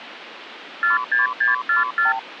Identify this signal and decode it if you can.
Multi-frequency trunk signalling (R2, with the far end's replies), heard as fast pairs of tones, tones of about 140 ms, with phone line noise. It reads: 46644